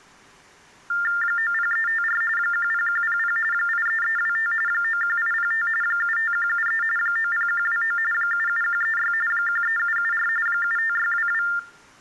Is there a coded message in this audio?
Yes: TTY/TDD text telephone tones (45.45 baud Baudot) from 0.9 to 11.6 s, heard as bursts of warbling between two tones, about 400 Hz shift, 1600 Hz centre. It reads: 90354 10100 83325 91805 75173 90129 77136 13774 75622